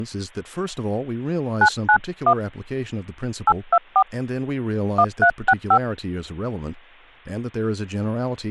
DTMF, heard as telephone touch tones, dialled by hand, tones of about 70 ms, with speech in English. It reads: 991 824 1365